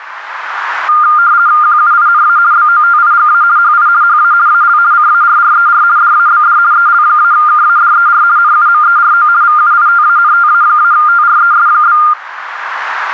RTTY (50 baud, 170 Hz shift), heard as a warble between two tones, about 1310 Hz centre, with radio static. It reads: QUINA BOTIGA HI HA AL CARRER DABD EL-KADER NUMERO VUITANTA-TRES?